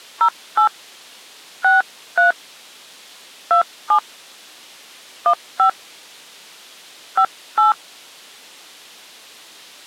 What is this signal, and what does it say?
DTMF, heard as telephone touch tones, dialled by hand, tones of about 120 ms. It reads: 08 63 27 15 58